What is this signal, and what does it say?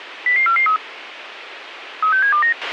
Five-tone selective call (CCIR), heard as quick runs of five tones, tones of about 100 ms, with radio hiss and a squelch burst at the end. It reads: 00443 36729